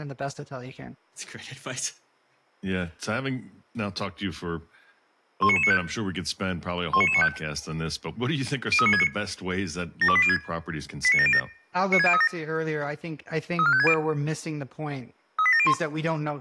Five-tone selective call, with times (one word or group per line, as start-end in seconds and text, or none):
5.4-5.8 19995
6.9-7.3 19995
8.7-9.1 03969
10.0-10.4 72806
11.0-11.4 89707
11.9-12.3 96037
13.6-13.9 34560
15.4-15.7 38701